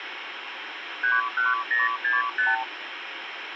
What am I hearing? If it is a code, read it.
Multi-frequency trunk signalling (R2, with the far end's replies), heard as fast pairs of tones, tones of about 170 ms, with phone line noise. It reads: 31065